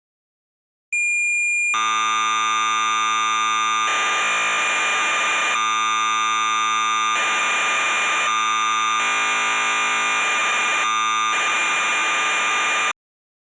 Cassette data (Kansas City type), 1200 baud, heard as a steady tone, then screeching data.